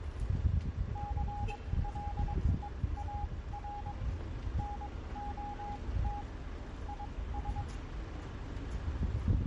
Morse code, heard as a keyed tone, machine-sent, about 22 wpm, spaced as for 17 wpm, 820 Hz, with street noise. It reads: CLEAR NOT IS